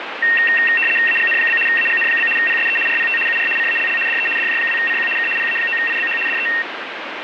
RTTY (75 baud, 850 Hz shift), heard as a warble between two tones, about 2300 Hz centre, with radio static. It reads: AGN? AGN? PSE RPT UR CALL DE DJ2CQ K PA9IBH DE